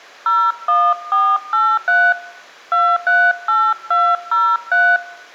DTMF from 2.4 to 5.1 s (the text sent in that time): 238203